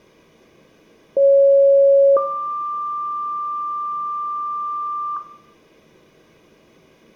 Two-tone page, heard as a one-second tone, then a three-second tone, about 550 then 1180 Hz, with room echo.